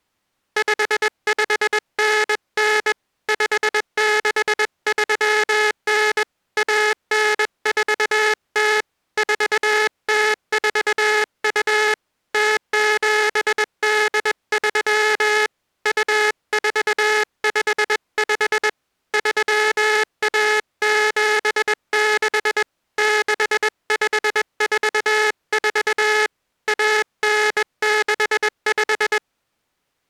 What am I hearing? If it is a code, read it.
Morse code (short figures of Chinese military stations), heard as a buzzer, hand-sent with a bug key, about 21 wpm. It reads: 5599 5639 1940 4042 0783 2455 3176 6544 1965